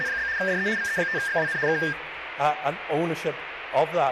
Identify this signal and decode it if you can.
RTTY (75 baud, 170 Hz shift), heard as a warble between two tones, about 1700 Hz centre, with radio static. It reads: … DE VE5XWN K